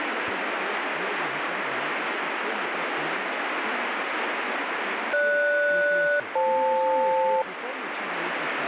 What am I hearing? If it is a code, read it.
Aircraft SELCAL, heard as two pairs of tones, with radio static and speech in Portuguese. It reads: GS-FL